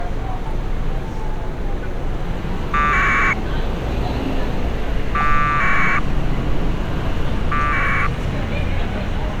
Packet radio (AX.25, as in APRS), 1200 baud, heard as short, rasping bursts, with street noise.